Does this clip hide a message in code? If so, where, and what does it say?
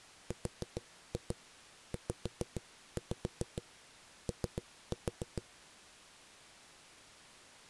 Yes: tap code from 0.3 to 5.4 s, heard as knocks on a wall, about 6 knocks a second. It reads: RZO